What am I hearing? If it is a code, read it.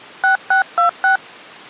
DTMF, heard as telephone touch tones, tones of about 120 ms. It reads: 6626